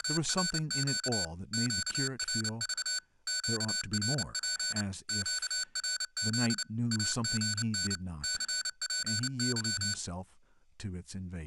Morse code, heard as electronic beeps, machine-sent, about 29 wpm, 1500 Hz, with speech in English. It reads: … QRV QRP QRZ AGN CPY